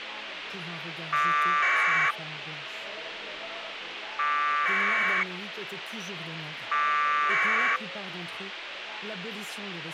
Packet radio (AX.25, as in APRS), 1200 baud, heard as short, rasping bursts, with radio hiss.